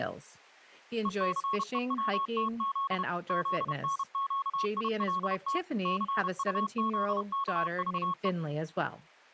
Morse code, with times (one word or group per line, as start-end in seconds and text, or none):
1.1-3.0 ECEWTZ
3.3-5.6 ZNQILT
5.9-8.3 CUZKVE